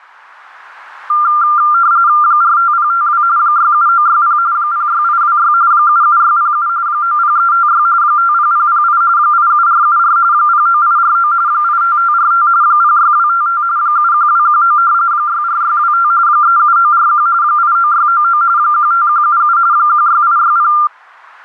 RTTY (45.45 baud, 170 Hz shift), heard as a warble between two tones, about 1290 Hz centre. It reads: 45052 67960 06826 77607 90356 50008 87474 09849 85545 06255 71219 64625 37941 89699 15177 16860